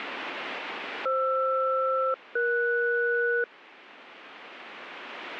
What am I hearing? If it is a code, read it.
Aircraft SELCAL, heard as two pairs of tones. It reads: FR-ES